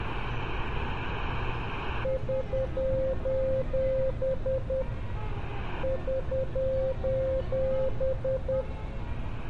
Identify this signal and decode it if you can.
Morse code, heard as a keyed tone, hand-sent with a paddle, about 10 wpm, 530 Hz, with street noise. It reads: <SOS> <SOS>